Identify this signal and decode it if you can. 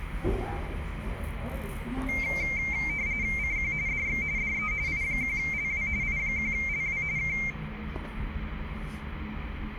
RTTY (45.45 baud, 170 Hz shift), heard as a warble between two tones, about 2200 Hz centre, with radio static, room echo and the noise inside a lift. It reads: CQ DX DE I1LW I1LW K